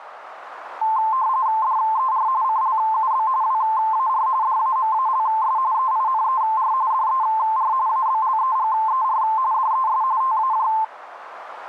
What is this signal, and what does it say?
RTTY (45.45 baud, 170 Hz shift), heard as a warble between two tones, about 960 Hz centre, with radio static. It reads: DER CLUB WAR DAMALS EINER DER ABLEGER DES TAJ